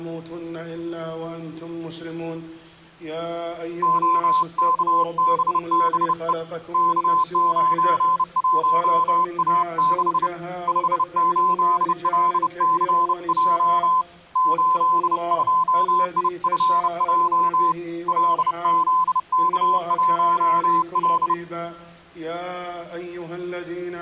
Morse code, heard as a keyed tone, hand-sent with a bug key, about 30 wpm, 1020 Hz. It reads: OKBBE K91A6 58LCJ 82IFJ LZK1L